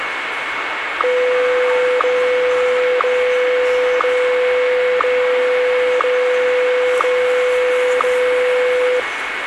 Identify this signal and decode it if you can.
Radio time signal (WWVH, Hawaii), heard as ticks, one a second, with radio static and the noise of a subway station.